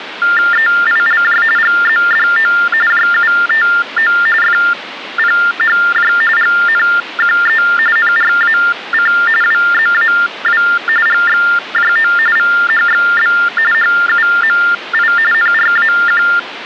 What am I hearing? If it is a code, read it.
TTY/TDD text telephone tones (45.45 baud Baudot), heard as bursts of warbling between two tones, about 400 Hz shift, 1600 Hz centre, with phone line noise. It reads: EILJ GZDO JUTO FPHJ GNQE NRAC WZAW GXJO VHXB HUMI NRAQ